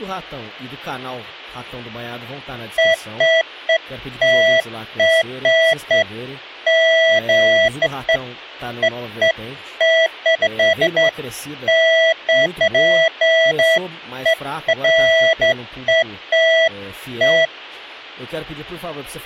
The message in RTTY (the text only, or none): none